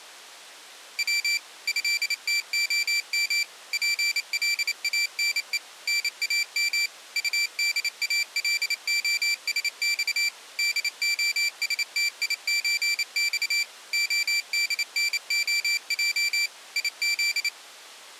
Morse code (Russian alphabet), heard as a high beeper, machine-sent, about 28 wpm, 2350 Hz. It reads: В ЭТОМ ПЛАНЕ НАМ УДАЛОСЬ ДОСТИЧЬ ОДНОЙ ИЗ